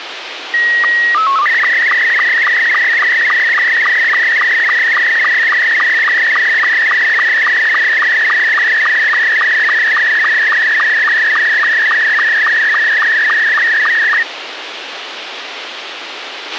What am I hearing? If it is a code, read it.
SSTV (slow-scan television), Scottie S2, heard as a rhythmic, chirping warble, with radio hiss and a squelch burst at the end.